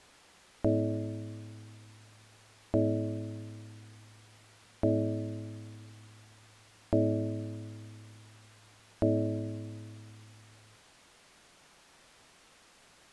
Clock strike, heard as a bell. 5. Five o'clock.